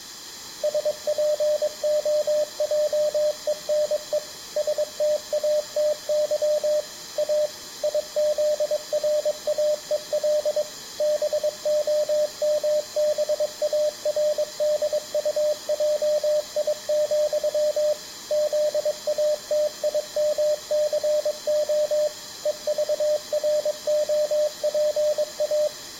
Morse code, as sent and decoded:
... .--. --- .--- . -. . / ... - .- - -.-- / .- / .. --.. .-. .- . .-.. / -... --- -- -... .- .-. -.. ..- .--- .. --..-- / --.. .- - .. -- -.-. --- / . ...- .-. --- .--. .-
SPOJENE STATY A IZRAEL BOMBARDUJI, ZATIMCO EVROPA

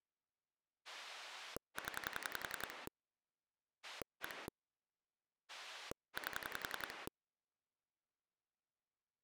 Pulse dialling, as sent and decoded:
10 / 1 / 8
0 1 8

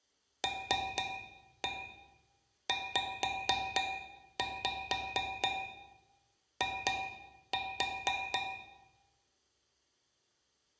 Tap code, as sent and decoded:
3-1 5-5 2-4
LZI

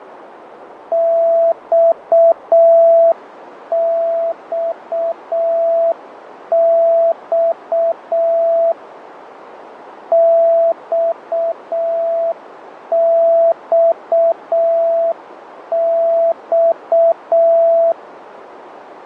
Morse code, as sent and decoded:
-..- -..- -..- / -..- -..- -..-
XXX XXX

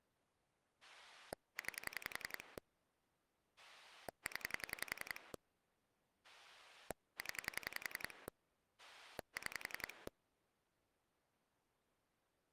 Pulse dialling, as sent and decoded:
9 / 10 / 10 / 6
9 0 0 6

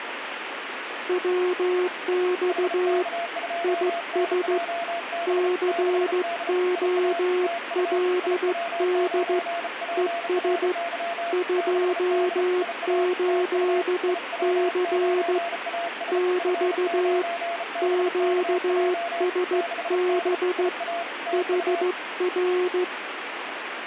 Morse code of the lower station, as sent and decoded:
.-- -..- / .. ... / -.-. --- .-.. -.. / . ... / ..--- ---.. -.-. / -...- / --.- ... -... / .... .-.
WX IS COLD ES 28C <BT> QSB HR

